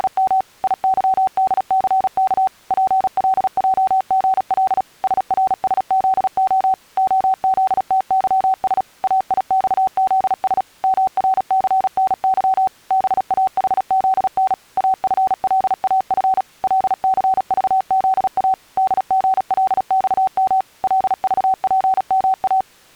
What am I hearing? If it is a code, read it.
Morse code, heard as a keyed tone, machine-sent, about 36 wpm, 760 Hz. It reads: … IYDCK PLJGL SRSZO OZTYS AIXZS MRCNY BAHZN AFLAF LCVZA DGLXM LVPMA